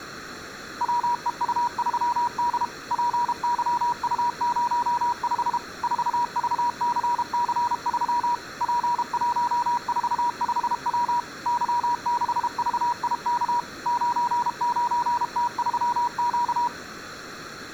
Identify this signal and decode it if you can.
Morse code, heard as a keyed tone, machine-sent, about 32 wpm, 960 Hz. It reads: WEU3D PYU05 4VCC3 P145W Y6VIK 99T3Q